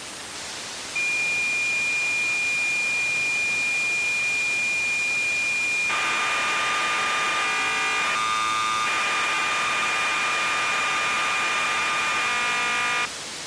Cassette data (Kansas City type), 1200 baud, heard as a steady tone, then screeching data, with tape hiss.